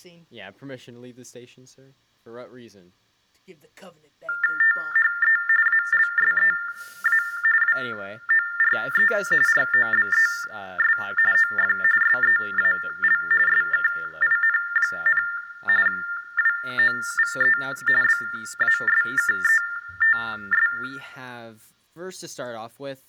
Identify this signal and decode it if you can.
TTY/TDD text telephone tones (45.45 baud Baudot), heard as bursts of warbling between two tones, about 400 Hz shift, 1600 Hz centre, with room echo and speech in English. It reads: THE ALSEA WORE ROBES OF SEAL SKIN, WOVE BASKETS